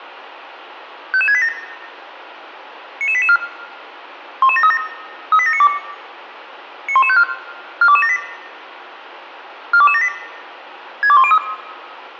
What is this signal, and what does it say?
Five-tone selective call (ZVEI), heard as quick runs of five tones, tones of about 70 ms, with room echo. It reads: 55687 99884 11737 38792 91154 42278 42278 62103